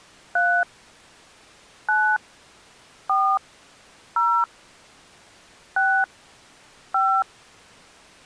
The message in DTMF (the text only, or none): 3 9 4 0 6 5